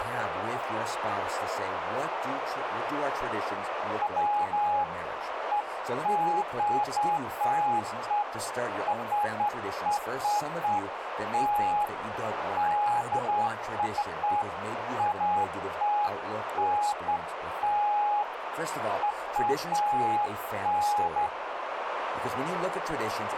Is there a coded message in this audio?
No, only beeps of irregular length, with radio static, a narrow filter and speech in English.